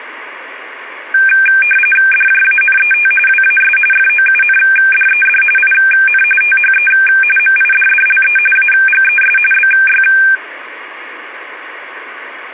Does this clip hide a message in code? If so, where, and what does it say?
Yes: RTTY (45.45 baud, 850 Hz shift) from 1.1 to 10.4 s, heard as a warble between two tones, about 2000 Hz centre. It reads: DJANET WAS FOUNDED IN THE MIDDLE AGES BY